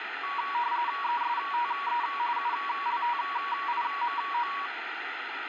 RTTY (45.45 baud, 170 Hz shift), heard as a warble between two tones, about 1040 Hz centre, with radio static. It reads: ESTE ULTIMO